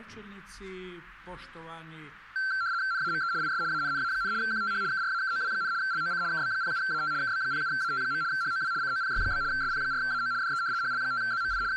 RTTY (75 baud, 170 Hz shift), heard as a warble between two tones, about 1460 Hz centre. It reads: NAME IS ANNA, QTH KRAKOW, LOC KB07AT KB07AT. HOW COPY? SP4AO DE HL5ZMI …